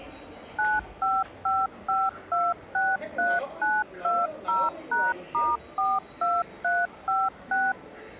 DTMF, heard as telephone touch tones, dialled by machine, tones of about 210 ms, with the noise of a subway station. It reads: 9555263920#*42356